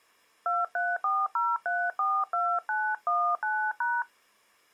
DTMF, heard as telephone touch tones, dialled by hand, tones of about 230 ms. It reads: 2340342919#